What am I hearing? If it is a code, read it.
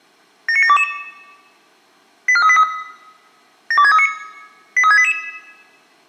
Five-tone selective call (ZVEI), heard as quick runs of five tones, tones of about 70 ms, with room echo. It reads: 79722 84383 72639 83688